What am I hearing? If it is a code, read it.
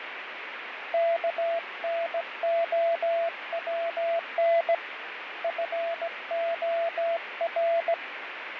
Morse code, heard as a keyed tone, hand-sent with a straight key, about 17 wpm, 670 Hz, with radio static and fading. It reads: KNOWN FOR